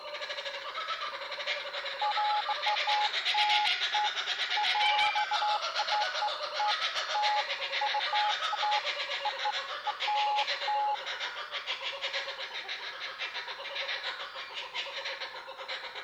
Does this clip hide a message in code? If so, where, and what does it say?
No, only beeps of irregular length.